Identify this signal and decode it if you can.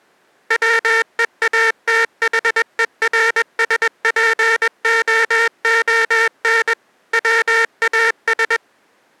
Morse code, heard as a buzzer, machine-sent, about 21 wpm. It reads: WEATHERSPOON WAS